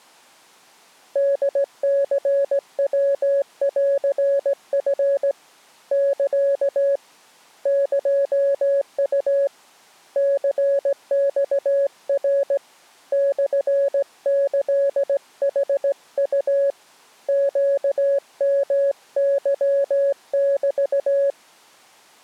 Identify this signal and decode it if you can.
Morse code (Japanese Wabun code), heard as a keyed tone, hand-sent with a straight key, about 17 wpm, 560 Hz. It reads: ホニヤンチ サ エウ ニマナ モキヌウ ネヨケメ